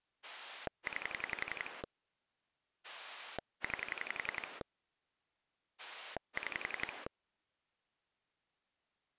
Pulse dialling, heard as a rotary dial, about 11 pulses a second. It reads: 9 9 6